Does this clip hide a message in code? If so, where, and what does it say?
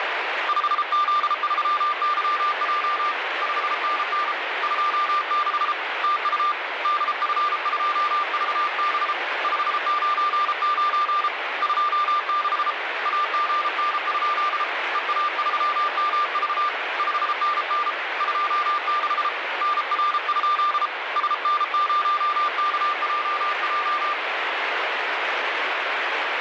Yes: Morse code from 0.4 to 24.2 s, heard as a keyed tone, hand-sent with a paddle, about 33 wpm, 1190 Hz, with radio static. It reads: 5Z3YJ 5NN 26 TU DF2VB 599 26 AGN? EA3MV 5NN 26 NR? SN0KJJ